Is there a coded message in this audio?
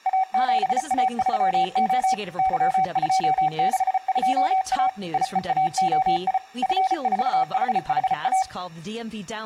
Yes: Morse code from 0.0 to 8.5 s, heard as a keyed tone, machine-sent, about 34 wpm, 760 Hz, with speech in English. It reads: A7A3O Y262A IEAOI F4HHA